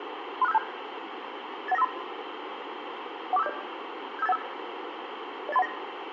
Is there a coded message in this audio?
Yes: five-tone selective call (EIA) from 0.4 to 5.7 s, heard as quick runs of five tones, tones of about 30 ms, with radio hiss and room echo. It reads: 36572 81953 14570 75815 08319